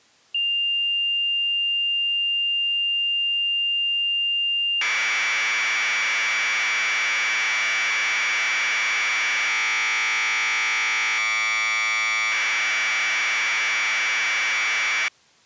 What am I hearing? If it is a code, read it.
Commodore tape loading (standard loader), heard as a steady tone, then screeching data.